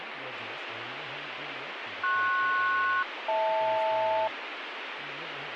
Aircraft SELCAL, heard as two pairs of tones, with radio static and speech in English. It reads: PS-HL